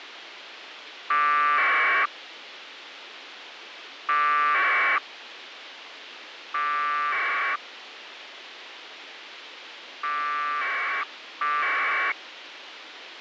Packet radio (AX.25, as in APRS), 1200 baud, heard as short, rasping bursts, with radio hiss.